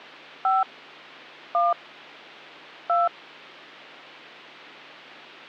DTMF, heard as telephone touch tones, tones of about 180 ms. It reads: 5 1 2